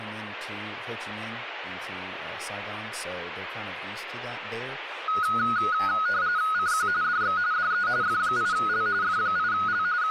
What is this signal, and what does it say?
RTTY (45.45 baud, 170 Hz shift), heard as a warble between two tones, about 1360 Hz centre, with radio static and speech in English. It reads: CQ DX DE F8L F8L …